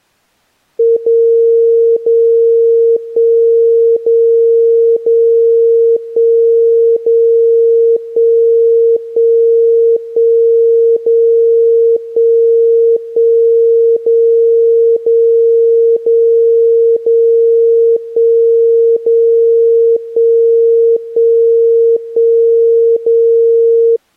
Radio time signal (DCF77), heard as a tone whose level steps once a second, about 460 Hz. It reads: 0 0 1 0 0 1 0 1 1 1 0 1 1 0 0 0 0 1 0 1 1 1 0